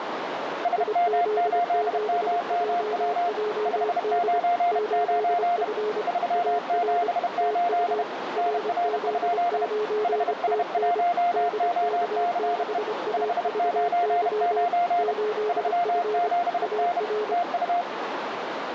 Morse code, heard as two keyed tones, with radio static and a narrow filter. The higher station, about 31 wpm, 700 Hz: SM8MMW 599 378 NR? HS1OCE 599 37N TU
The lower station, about 25 wpm, 420 Hz: IZ7JJD 8F AR TU RZ9TN DK6AVY 8F AR